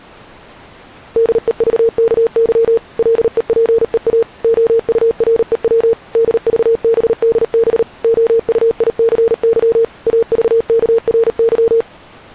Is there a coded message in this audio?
Yes: Morse code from 1.1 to 11.9 s, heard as a keyed tone, machine-sent, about 38 wpm, 460 Hz. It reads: DEVKY LEPEA OUREW DVBDB OUICY AVKRY